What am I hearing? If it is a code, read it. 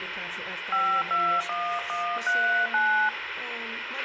DTMF, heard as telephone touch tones, dialled by hand, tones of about 300 ms, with radio hiss and a squelch burst at the end. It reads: 521139